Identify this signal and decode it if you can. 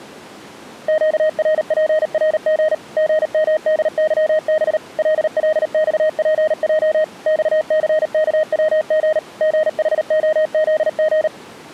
Morse code, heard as a keyed tone, machine-sent, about 38 wpm, 620 Hz. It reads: QRPRG GMDYB LLXPJ XCKWG GHOZG